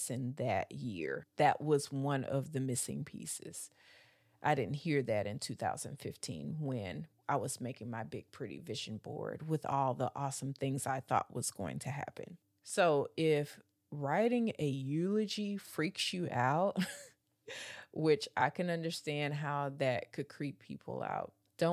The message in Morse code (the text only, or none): none